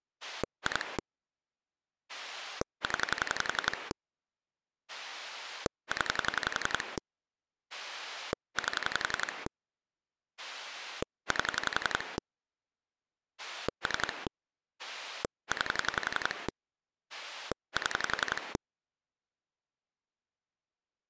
Pulse dialling, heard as a rotary dial, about 11 pulses a second. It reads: 2 0 0 8 8 3 9 7